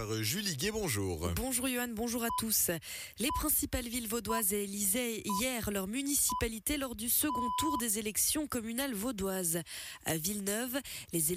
Radio time signal (six pips, as the Greenwich Time Signal), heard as pips.